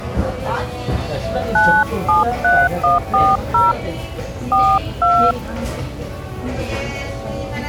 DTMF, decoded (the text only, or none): 973140 42